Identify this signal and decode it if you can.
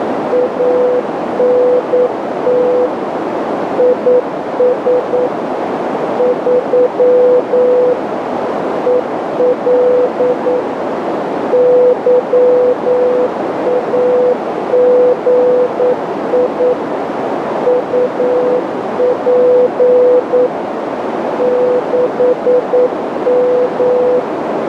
Morse code, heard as a keyed tone, machine-sent, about 9 wpm, 500 Hz, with heavy radio static and a narrow filter. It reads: ANT IS 3 EL YAGI UP 6M